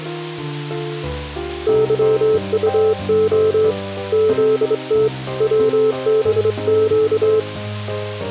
Morse code (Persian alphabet), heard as a keyed tone, hand-sent with a straight key, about 25 wpm, 440 Hz. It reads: ظطع زت وبگ